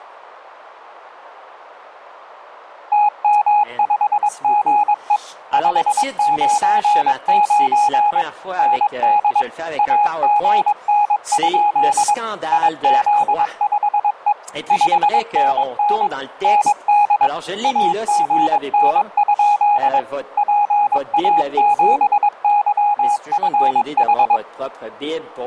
Morse code, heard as a keyed tone, machine-sent, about 22 wpm, 830 Hz. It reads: TM5GE 599 ND AGN? IZ5E 5NN ND AGN? PA7YFH